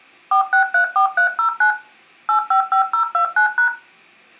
DTMF, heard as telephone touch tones, dialled by machine, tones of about 100 ms. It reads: 4634309 855029#